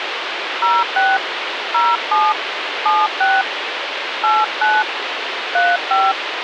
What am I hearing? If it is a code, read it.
DTMF, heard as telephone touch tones, dialled by hand, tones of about 210 ms, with radio hiss. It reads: 06 07 76 89 35